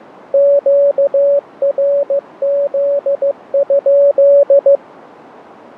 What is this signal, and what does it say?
Morse code, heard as a keyed tone, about 15 wpm, 570 Hz. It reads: QRZ?